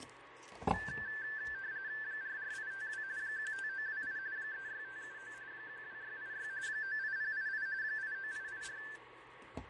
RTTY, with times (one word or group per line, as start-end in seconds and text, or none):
2.0-3.0 44852
3.2-4.2 15928
4.4-5.3 36579
5.5-6.5 12686
6.7-7.7 98088
7.8-8.8 89884